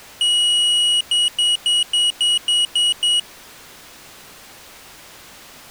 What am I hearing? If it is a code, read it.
Beep code, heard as a piezo beeper, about 2900 Hz. 1 long, 8 short. In AMI BIOS tables: display or retrace test failure.